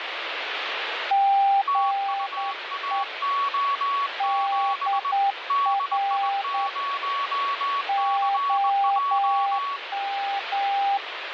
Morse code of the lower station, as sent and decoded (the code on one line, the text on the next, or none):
--. . / -.. .-. / --- --
GE DR OM